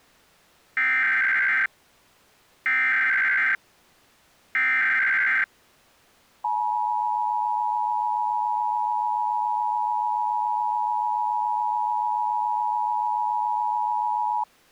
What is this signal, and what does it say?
Emergency Alert System (SAME) tones (header bursts, then the 853 and 960 Hz attention tone), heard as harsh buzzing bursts, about 520.83 baud.